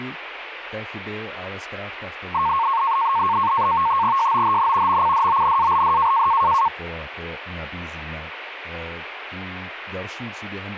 NAVTEX (SITOR-B), 100 baud, 170 Hz shift, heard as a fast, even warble, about 1000 Hz centre, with radio static and speech in Czech. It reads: JOHN MCDONALD